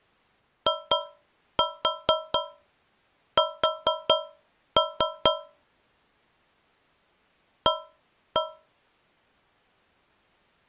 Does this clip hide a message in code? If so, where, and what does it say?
Yes: tap code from 0.7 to 8.8 s, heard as taps on a metal pipe, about 4 knocks a second. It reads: IS A